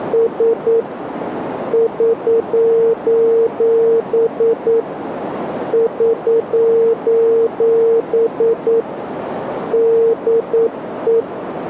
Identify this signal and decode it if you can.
Morse code, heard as a keyed tone, machine-sent, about 9 wpm, 460 Hz, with radio static and a narrow filter. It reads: … <SOS> <SOS> DE